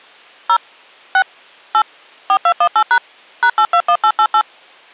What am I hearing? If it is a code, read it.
DTMF, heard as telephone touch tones, dialled by machine, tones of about 70 ms. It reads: 0 6 8 4218# #821888